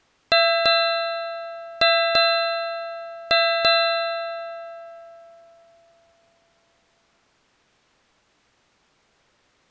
Ship's bell, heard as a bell. 6. Six half-hours of the watch have passed.